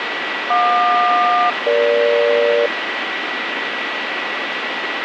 Aircraft SELCAL, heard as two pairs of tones, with radio static and a steady whistle near 1940 Hz. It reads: JQ-EG